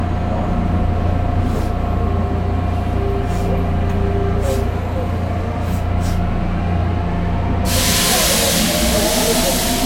The noise inside a subway train. There is no code.